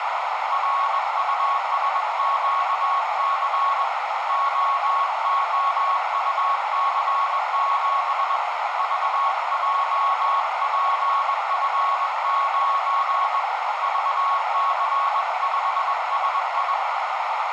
Morse code, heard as a keyed tone, hand-sent with a bug key, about 21 wpm, 1100 Hz, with heavy radio static and a narrow filter. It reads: RUSQC OOUC7 VJPF9 VC5SI